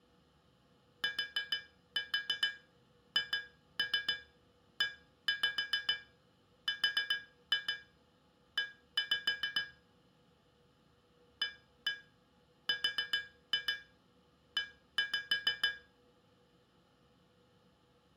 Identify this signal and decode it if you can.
Tap code, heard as taps on glass, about 6 knocks a second, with room echo. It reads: THERE ARE